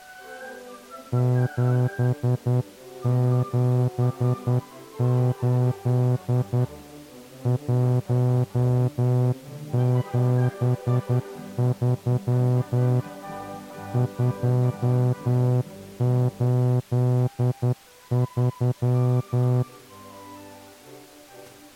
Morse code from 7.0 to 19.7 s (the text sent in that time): 173 283